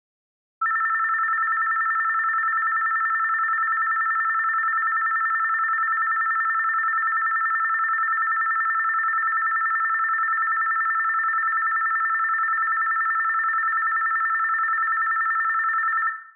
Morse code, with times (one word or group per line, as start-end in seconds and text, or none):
none